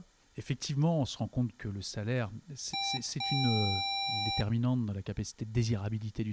Beep code, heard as beeps from a small speaker, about 790 Hz, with room echo and speech in French. 1 short, 1 long.